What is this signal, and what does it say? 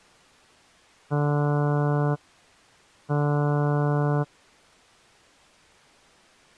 Ship horn signal, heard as a ship's horn, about 150 Hz. 2 short. At sea: I am altering course to port.